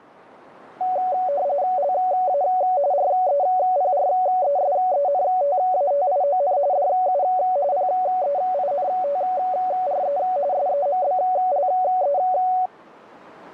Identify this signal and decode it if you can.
RTTY (45.45 baud, 170 Hz shift), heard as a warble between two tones, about 660 Hz centre. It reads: LA REPRESENTATION DU PEINTRE SEMBLE